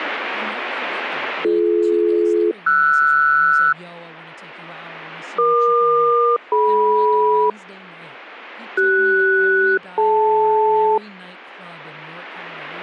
Aircraft SELCAL, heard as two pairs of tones, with speech in English. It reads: BD-RS EQ-DM CS-DL